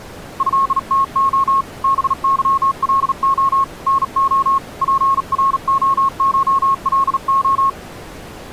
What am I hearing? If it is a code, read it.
Morse code (Russian alphabet), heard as a keyed tone, hand-sent with a bug key, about 38 wpm, 1090 Hz. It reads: ЭТО БЫЛО НО ПРОШЛО